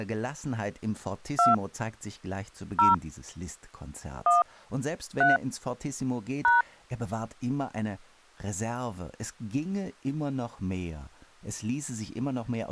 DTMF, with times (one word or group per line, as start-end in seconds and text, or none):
1.4-1.5 2
2.8-2.9 0
4.3-4.4 1
5.2-5.4 3
6.4-6.6 #